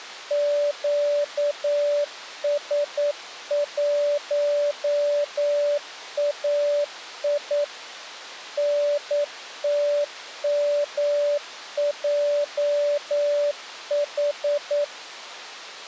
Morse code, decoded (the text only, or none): QS1AI NTMJH